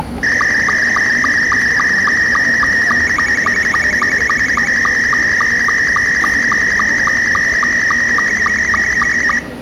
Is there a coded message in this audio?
Yes: SSTV (slow-scan television), Scottie S2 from 0.2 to 9.4 s, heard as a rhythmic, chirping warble, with the noise of a cafe.